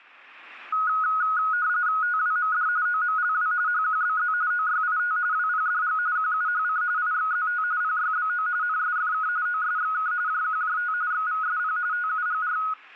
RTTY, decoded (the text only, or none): TWMD OMLW HQBZ OYIT WPDG QUHC IXZT PYBO NSFK OSXK JQJT XVSP TUGR